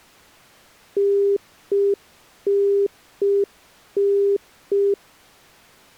Telephone call progress tone (UK plan), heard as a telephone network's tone, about 400 Hz. Congestion tone.